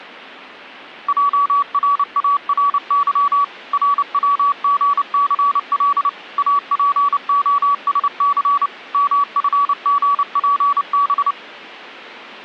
Morse code, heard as a keyed tone, machine-sent, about 29 wpm, 1140 Hz. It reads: JRARY RWGCL APOSC MFGPB